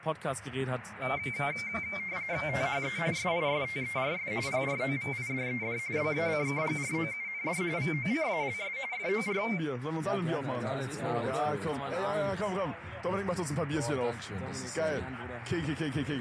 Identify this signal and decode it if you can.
RTTY (45.45 baud, 170 Hz shift), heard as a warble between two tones, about 2200 Hz centre. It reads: THE SISTERS PROVIDED BACKGROUND VOCALS FOR